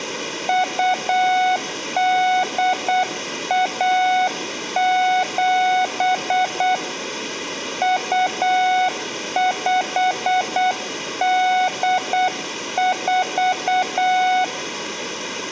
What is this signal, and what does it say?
Morse code (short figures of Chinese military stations), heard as a keyed tone, hand-sent with a paddle, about 8 wpm, 740 Hz, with room echo. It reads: 2817 2584